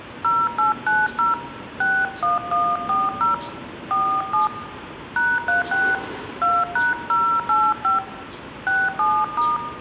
DTMF, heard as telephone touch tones, dialled by hand, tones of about 220 ms, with room echo and the noise of a residential street. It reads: 0890 61140 47 #36 2#085 67*